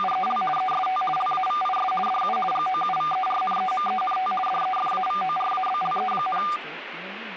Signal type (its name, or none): RTTY